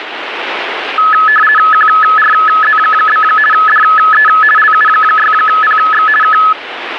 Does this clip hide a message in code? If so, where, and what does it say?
Yes: RTTY (50 baud, 450 Hz shift) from 1.0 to 6.5 s, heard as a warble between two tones, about 1500 Hz centre, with radio static. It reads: QRZ? DE LU6PX K